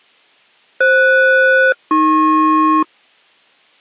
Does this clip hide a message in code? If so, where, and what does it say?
Yes: aircraft SELCAL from 0.8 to 2.8 s, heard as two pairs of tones. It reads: FS-AP